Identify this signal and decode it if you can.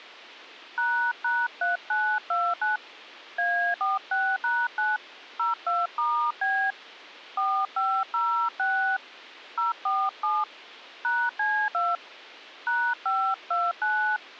DTMF, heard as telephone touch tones, dialled by hand, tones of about 260 ms. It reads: ##3929 A46#9 02*B 4506 047 #C2 #529